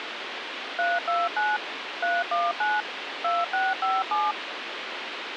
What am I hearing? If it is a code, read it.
DTMF, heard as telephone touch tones, dialled by machine, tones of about 200 ms, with radio hiss. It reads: 329 319 2657